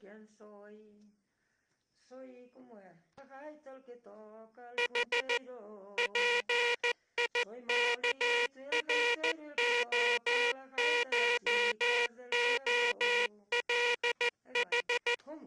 Morse code (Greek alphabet), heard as a buzzer, machine-sent, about 14 wpm. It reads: Η ΠΙΚΡΟΧΟΛΗ